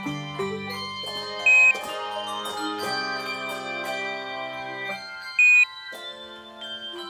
Quindar tones, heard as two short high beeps.